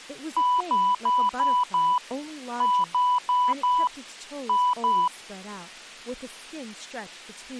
Beep code, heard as beeps, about 990 Hz, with speech in English. 5-4-2.